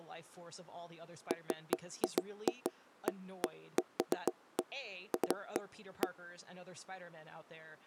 Irregular knocks on wood, with speech in English. There is no code.